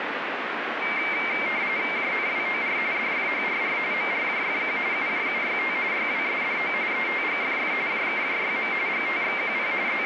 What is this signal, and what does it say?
RTTY (45.45 baud, 170 Hz shift), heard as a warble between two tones, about 2200 Hz centre, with radio static. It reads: JNWOR DFHRR MRJFQ UJUYT YWSDO ETGFF JKJYM GTXQP …